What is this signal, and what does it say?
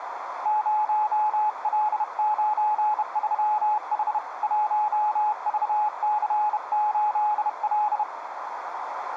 Morse code, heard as a keyed tone, hand-sent with a bug key, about 31 wpm, 850 Hz, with radio static and a narrow filter. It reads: 0L93H 1VC8L